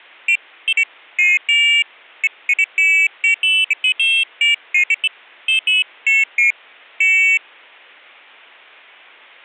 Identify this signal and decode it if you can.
Pairs of high tones at irregular times. There is no code.